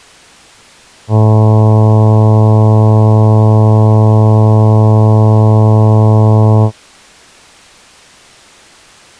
Ship horn signal, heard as a ship's horn, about 110 Hz. 1 long. At sea: a vessel nearing a blind bend, or under power and making way in fog.